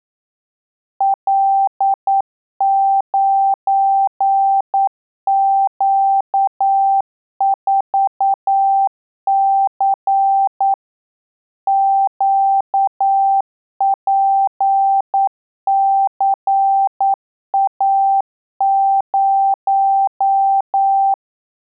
Morse code, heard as a keyed tone, machine-sent, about 9 wpm, 780 Hz. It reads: L9Q4C QPCA0